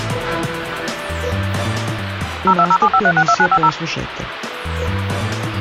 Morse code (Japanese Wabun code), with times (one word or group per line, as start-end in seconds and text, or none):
none